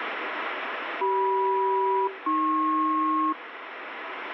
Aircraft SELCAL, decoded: CM-AP

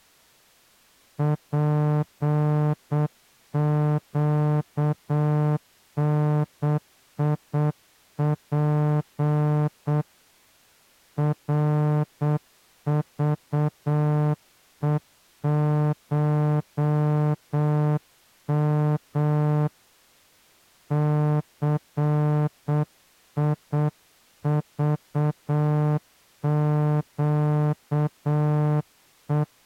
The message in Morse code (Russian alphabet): ПЩНИП РЖЕШМ ЦИЖЩЕ

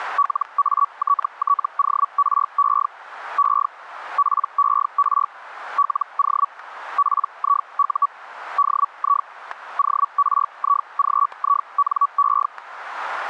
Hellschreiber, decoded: LATTORE E PER LO PIU DI ORIGINE

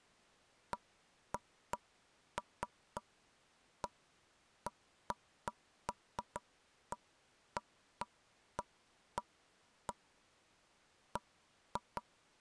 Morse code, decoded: none

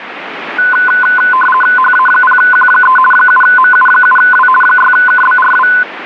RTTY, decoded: HA0Q3 7MU7W 6KBRW

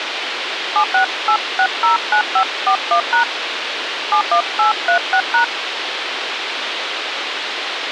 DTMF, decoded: 768609541# 71836#

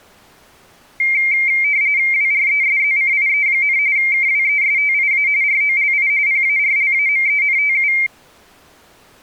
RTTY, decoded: WRESZCIE, KWESTIA ROLI PARLAMENTU

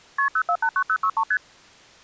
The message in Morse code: none

